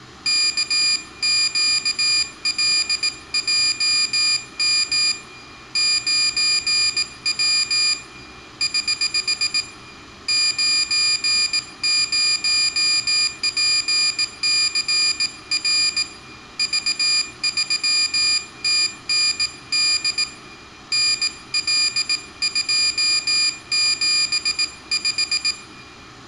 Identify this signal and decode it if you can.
Morse code, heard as a high beeper, hand-sent with a bug key, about 18 wpm, 2400 Hz, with room echo. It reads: KQLJM 9W <HH> 90PCR V3TND NL275